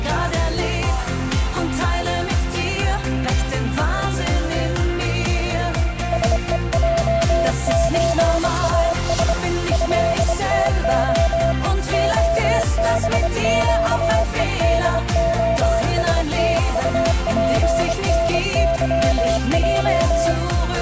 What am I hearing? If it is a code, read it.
Morse code (Russian alphabet), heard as a keyed tone, hand-sent with a bug key, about 25 wpm, 670 Hz. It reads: СЕЙЧАС ЭТО ОБЩЕДОСТУПНЫЙ